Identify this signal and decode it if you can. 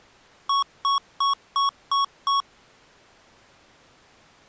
Beep code, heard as beeps from a small speaker, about 1110 Hz. 6 short. In AMI BIOS tables: keyboard controller gate A20 failure; in Dell tables: video card failure.